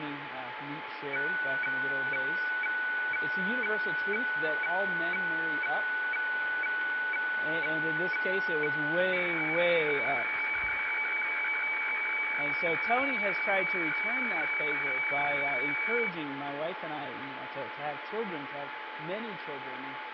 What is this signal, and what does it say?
Weather fax (radiofax), 120 lines a minute, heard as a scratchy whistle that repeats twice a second, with radio static.